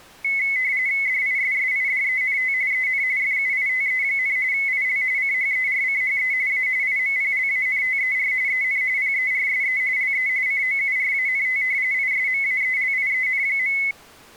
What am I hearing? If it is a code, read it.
RTTY (45.45 baud, 170 Hz shift), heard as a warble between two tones, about 2100 Hz centre. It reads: DISSIDENT EN FUITE, IL CHERCHE A IMPLANTER EN PERSE LE COURANT ISMAELIEN.